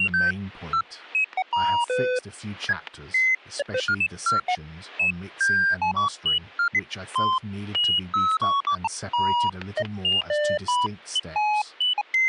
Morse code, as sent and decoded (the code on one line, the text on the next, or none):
none